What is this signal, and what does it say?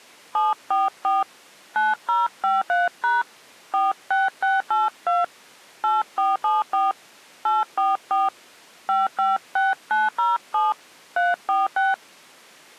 DTMF, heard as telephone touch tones, dialled by hand, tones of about 180 ms. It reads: 744 9053# 46682 8474 844 556907 346